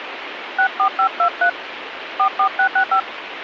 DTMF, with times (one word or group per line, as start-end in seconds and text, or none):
0.6-1.5 64523
2.2-3.0 44665